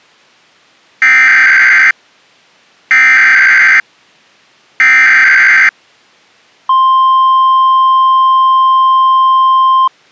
Emergency Alert System (SAME) tones (header bursts, then the 1050 Hz attention tone), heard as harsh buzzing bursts, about 520.83 baud.